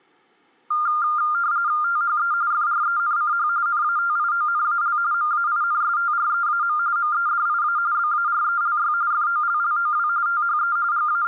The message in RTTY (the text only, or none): THE FRENCH NATIONAL MAINSTREAM MEDIA BARELY FOLLOW THE …